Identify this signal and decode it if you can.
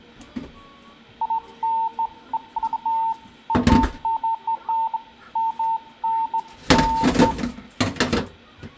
Beeps of irregular length, with room echo and kitchen noise. There is no code.